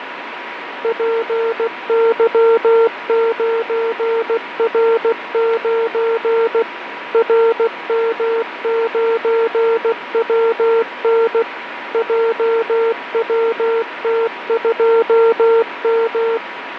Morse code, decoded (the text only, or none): PY9R9 RM9WN JWT2M